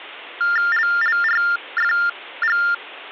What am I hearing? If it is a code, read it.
TTY/TDD text telephone tones (45.45 baud Baudot), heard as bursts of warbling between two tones, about 400 Hz shift, 1600 Hz centre. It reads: LLRFG